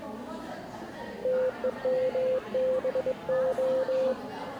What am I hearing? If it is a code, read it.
Morse code, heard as a keyed tone, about 22 wpm, 520 Hz, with the noise of a crowd indoors. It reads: TEMBO